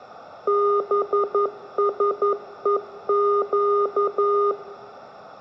Morse code (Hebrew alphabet), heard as electronic beeps, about 11 wpm, 410 Hz, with room echo. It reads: בשוק